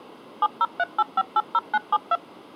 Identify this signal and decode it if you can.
DTMF, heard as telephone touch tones, dialled by machine, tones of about 40 ms. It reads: 7038580972